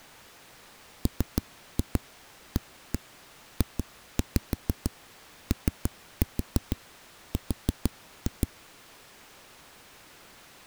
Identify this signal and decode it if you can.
Tap code, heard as knocks on a wall, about 6 knocks a second. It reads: MAJOR